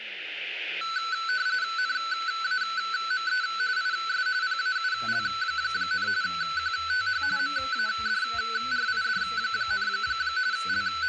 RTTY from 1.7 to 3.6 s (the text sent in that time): NAME